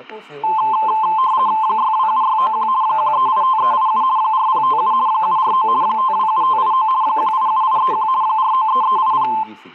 RTTY (50 baud, 170 Hz shift), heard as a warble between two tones, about 960 Hz centre, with static crashes and speech in Greek. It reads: 627691 1385387 4057 749 527589 187831 493380